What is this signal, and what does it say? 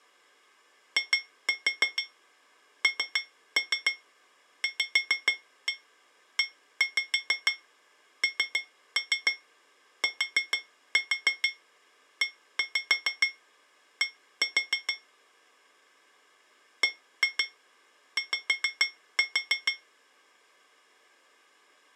Tap code, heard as taps on glass, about 6 knocks a second. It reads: INVENTED BY